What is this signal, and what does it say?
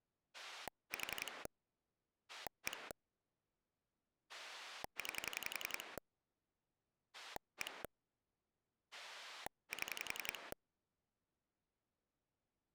Pulse dialling, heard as a rotary dial, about 11 pulses a second. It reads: 4 1 9 1 7